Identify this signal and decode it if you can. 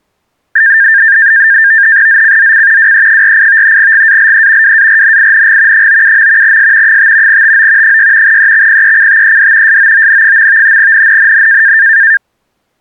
NAVTEX (SITOR-B), 100 baud, 170 Hz shift, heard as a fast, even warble, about 1700 Hz centre. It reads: ZCZC WE48 GALE WARNING 97. S 5 TO 6 EXPECTED SOON. NNNN